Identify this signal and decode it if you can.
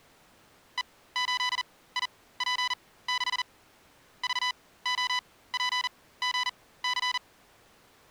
Morse code, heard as electronic beeps, machine-sent, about 40 wpm, spaced as for 19 wpm, 1000 Hz. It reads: E8IP6 VOPGC